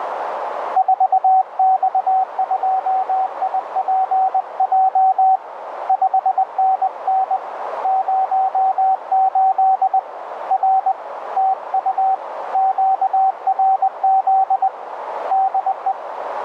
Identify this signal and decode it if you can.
Morse code, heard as a keyed tone, hand-sent with a paddle, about 20 wpm, 760 Hz, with radio static and a narrow filter. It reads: 4X2IPJ 5NN 08 R TU QRZ DE